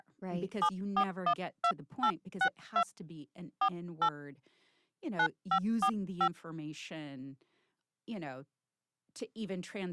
DTMF, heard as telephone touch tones, dialled by hand, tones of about 70 ms, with speech in English. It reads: 7412862 48 9545